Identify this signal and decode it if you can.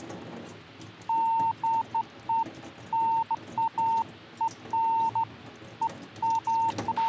Beeps of irregular length, with a squelch burst at the end and the noise of a restroom. There is no code.